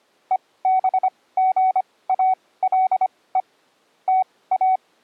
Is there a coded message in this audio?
Yes: Morse code (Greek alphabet) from 0.3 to 4.8 s, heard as a keyed tone, machine-sent, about 25 wpm, spaced as for 18 wpm, 750 Hz. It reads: ΕΒΓΑΛΕ ΤΑ